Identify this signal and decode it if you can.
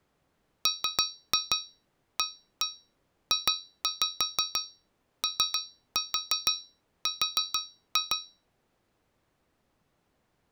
Tap code, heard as taps on a metal pipe, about 6 knocks a second. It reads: MAJOR